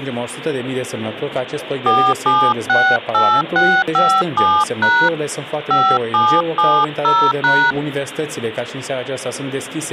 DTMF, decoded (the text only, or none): 4768657# 5770#